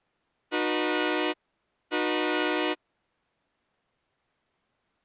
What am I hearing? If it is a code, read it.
Train horn signal, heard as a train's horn. 2 short. On North American railways: a signal is acknowledged.